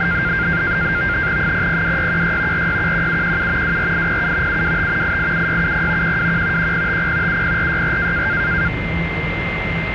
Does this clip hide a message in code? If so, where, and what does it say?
Yes: NAVTEX (SITOR-B), 100 baud, 170 Hz shift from 0.0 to 8.7 s, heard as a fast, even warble, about 1500 Hz centre, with radio static, a steady whistle near 2090 Hz and the noise inside a subway train. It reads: 002616 4611717 24807 725 887670 121 1050 70464